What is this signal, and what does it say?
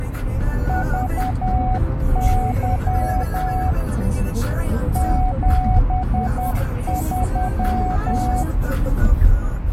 Morse code, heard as a keyed tone, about 10 wpm, 740 Hz, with radio static and the noise inside a car. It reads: VY 73